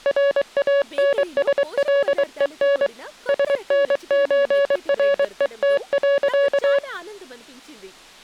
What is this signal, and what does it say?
Morse code (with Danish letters), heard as a keyed tone, hand-sent with a paddle, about 23 wpm, 560 Hz, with speech in Telugu. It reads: RANSLEN SNØRET.